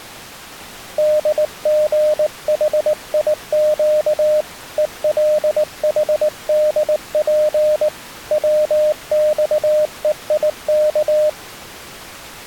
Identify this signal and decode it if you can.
Morse code, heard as a keyed tone, hand-sent with a paddle, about 19 wpm, 610 Hz. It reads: DGHIQ ELHDP WXEIK